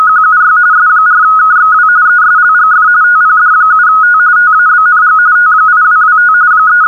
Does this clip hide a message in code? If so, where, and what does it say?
Yes: RTTY (45.45 baud, 170 Hz shift) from 0.0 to 6.9 s, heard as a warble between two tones, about 1360 Hz centre. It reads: … S4KXW ESLGF TPD7T TABNG T8225 …